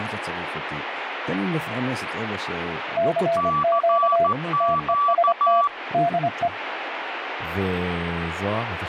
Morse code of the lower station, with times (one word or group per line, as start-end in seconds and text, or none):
3.0-4.3 CQ
4.6-5.6 TEST
5.9-6.5 DE